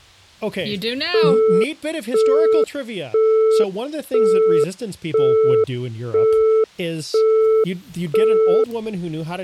Telephone call progress tone (single-tone plan, as in Europe, Japan and elsewhere), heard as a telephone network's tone, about 440 Hz, 0.5 s on and 0.5 s off, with speech in English. Busy tone.